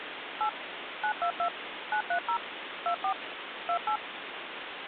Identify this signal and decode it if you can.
DTMF, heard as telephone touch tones, dialled by machine, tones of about 90 ms, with phone line noise. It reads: 8 922 930 24 28